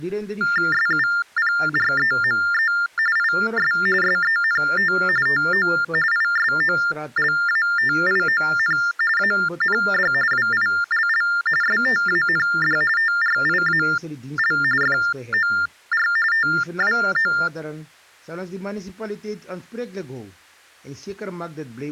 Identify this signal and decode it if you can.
TTY/TDD text telephone tones (45.45 baud Baudot), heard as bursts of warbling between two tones, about 400 Hz shift, 1600 Hz centre. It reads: SUPREME IS SENT TO ISOLATION AND WILL STAND TRIAL FOR TWO